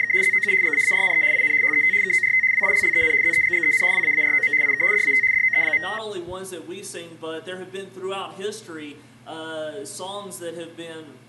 RTTY (75 baud, 170 Hz shift), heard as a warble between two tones, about 1950 Hz centre. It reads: … ZOU GAARNE IN HET KORT WILLEN ZEGGEN WAAROM IK DAT DOE.